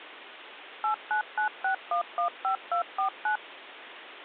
DTMF, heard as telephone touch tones, dialled by machine, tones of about 100 ms, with phone line noise. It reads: 8996115249